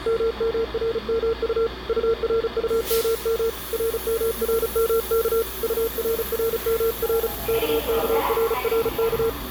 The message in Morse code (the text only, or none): MMRMU URUMM RMRMK URRMR KKRRK